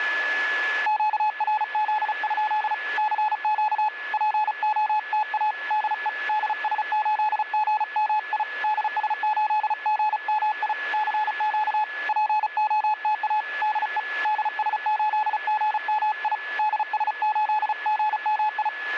Morse code, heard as a keyed tone, hand-sent with a paddle, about 35 wpm, 850 Hz, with radio static and a steady whistle near 1710 Hz. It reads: QRZ? CQ POTA DE DS8GMI DS8GMI CQ POTA DE DS8GMI DS8GMI